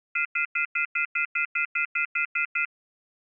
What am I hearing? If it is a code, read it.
Telephone call progress tone (North American plan), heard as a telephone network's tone, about 1400, 2050, 2450, 2600 Hz, 0.1 s on and 0.1 s off. Off-hook warning tone.